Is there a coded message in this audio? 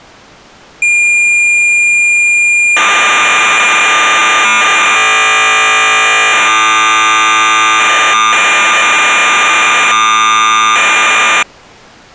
Yes: cassette data (Kansas City type), 1200 baud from 0.8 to 11.4 s, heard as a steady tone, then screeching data.